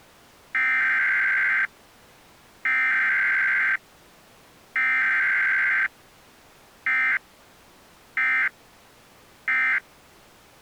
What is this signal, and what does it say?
Emergency Alert System (SAME) tones (header bursts, then end-of-message bursts), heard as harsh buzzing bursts, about 520.83 baud.